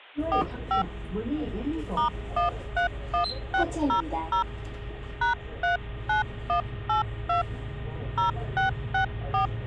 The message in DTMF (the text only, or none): 45 *131600 #39182 0664